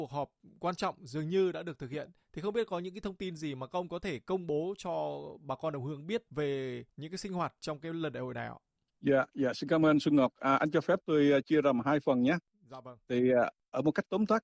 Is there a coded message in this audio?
No.